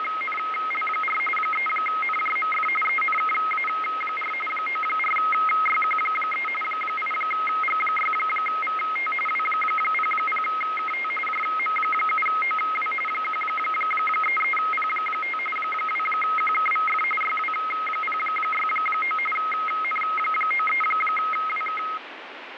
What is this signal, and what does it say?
RTTY (45.45 baud, 850 Hz shift), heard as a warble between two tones, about 1700 Hz centre, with radio static. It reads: … 3NJMF ENKA4 94YQ3 8G6VT W00KT JM7OW 133P5 2QKVF YW069 N93WK